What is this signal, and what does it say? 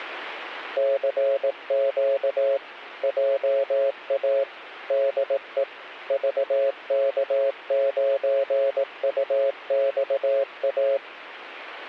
Morse code, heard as a keyed tone, machine-sent, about 18 wpm, 550 Hz. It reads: CQ JA DE VK9UXA